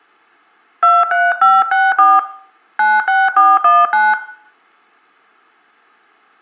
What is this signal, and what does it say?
DTMF, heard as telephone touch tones, dialled by hand, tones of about 210 ms, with room echo. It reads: 23564 96419